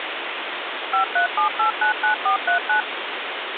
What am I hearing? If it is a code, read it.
DTMF, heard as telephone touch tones, dialled by machine, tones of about 110 ms, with phone line noise. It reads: 537899439